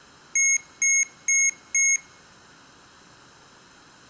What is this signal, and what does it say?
Beep code, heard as beeps from a small speaker, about 2150 Hz, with room echo. 4 short. In AMI BIOS tables: system timer failure; in Dell tables: memory read or write failure.